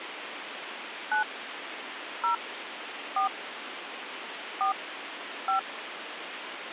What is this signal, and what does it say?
DTMF, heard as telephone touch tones, dialled by hand, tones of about 110 ms, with phone line noise. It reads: 9 0 4 4 5